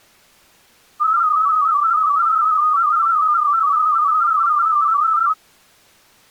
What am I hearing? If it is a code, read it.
Multi-tone FSK (Olivia or MFSK type), about 250 Hz wide, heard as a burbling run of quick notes, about 31.25 baud.